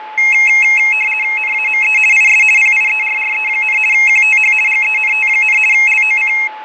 RTTY (50 baud, 450 Hz shift), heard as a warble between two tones, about 2350 Hz centre, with fading and a steady whistle near 860 Hz. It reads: NAME IS PIERRE, QTH GENT, LOC